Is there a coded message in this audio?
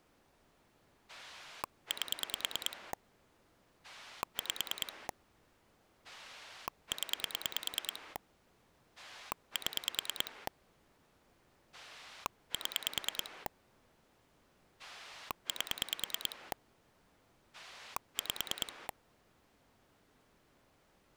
Yes: pulse dialling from 1.1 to 18.9 s, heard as a rotary dial, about 9 pulses a second. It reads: 8 5 0 7 7 8 5